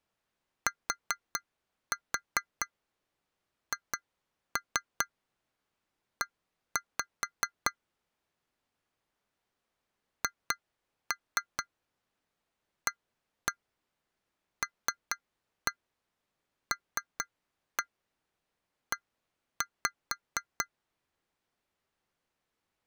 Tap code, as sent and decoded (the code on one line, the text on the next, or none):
4-4 2-3 1-5 / 2-3 1-1 3-1 3-1 1-5
THE HALLE